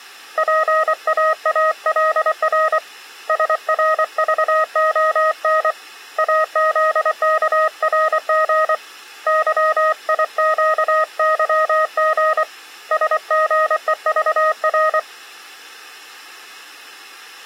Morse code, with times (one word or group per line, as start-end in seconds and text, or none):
0.4-2.8 PAALR
3.3-5.7 SRVON
6.2-8.7 AZKRG
9.3-12.4 YIQYG
12.9-15.0 SGEVR